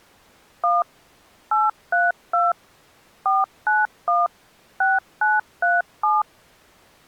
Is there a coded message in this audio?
Yes: DTMF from 0.6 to 6.2 s, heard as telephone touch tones, dialled by machine, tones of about 180 ms. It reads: 1 832 491 6937